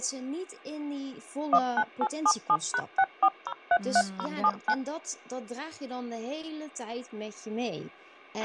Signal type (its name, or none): DTMF